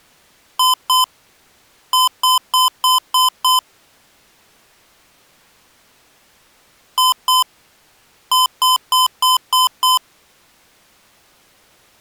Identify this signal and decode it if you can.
Beep code, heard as beeps from a small speaker, played twice, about 1020 Hz. 2-6.